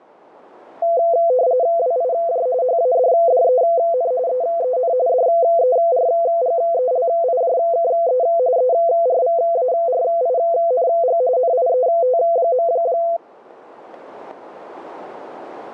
RTTY (45.45 baud, 170 Hz shift), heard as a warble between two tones, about 590 Hz centre. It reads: WIJ HADDEN EEN DERGELIJKE ERVARING NIET.